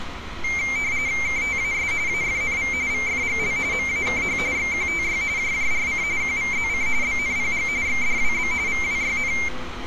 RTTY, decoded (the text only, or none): KTAS AFNV VFGL MAKH XQTY JJRC QVZC BNPG XDWB VWYN